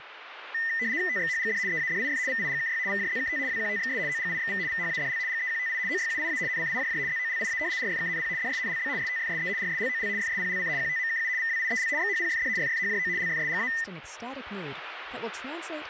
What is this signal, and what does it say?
RTTY (75 baud, 170 Hz shift), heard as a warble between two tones, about 1900 Hz centre, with radio static and speech in English. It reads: TXHGD EADIF VIGKY VJZKT WQTXS OGIXV VHADL GEQTI OYUIA NCIJJ ZOLIA RFKNP DSNLB STFSE RSLOL FSPLC QTMKU VWIEL XHPFD FFHJO LFSGA